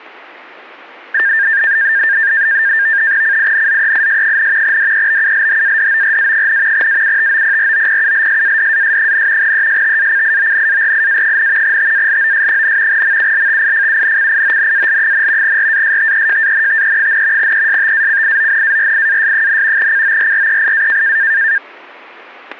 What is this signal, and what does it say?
NAVTEX (SITOR-B), 100 baud, 170 Hz shift, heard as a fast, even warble, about 1700 Hz centre, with static crashes. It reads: CINZEIS, DEBULHADORA, AUTOPROPULSADAS, ESTACIONARIA, TALOS, MULTIFUNCIONAL, RASTEJANTE, ESTACIONARIAS, CORREIA